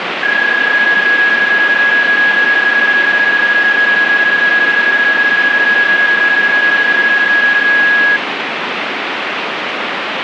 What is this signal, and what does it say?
PSK31 (31.25 baud), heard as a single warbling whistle, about 1650 Hz, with radio static.